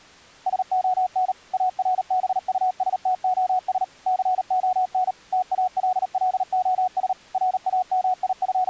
Morse code, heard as a keyed tone, machine-sent, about 38 wpm, 740 Hz. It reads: SON ARBUSTOS CON TALLOS …